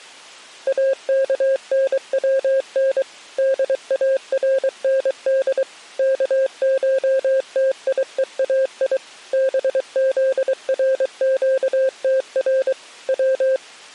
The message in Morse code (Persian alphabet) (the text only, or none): اکنون دارند کشتیهای بزرگتر و